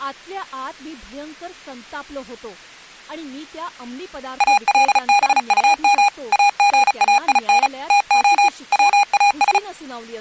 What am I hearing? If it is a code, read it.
Morse code, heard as electronic beeps, machine-sent, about 35 wpm, 810 Hz, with speech in Marathi. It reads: ALBUM AGAIN TO WAS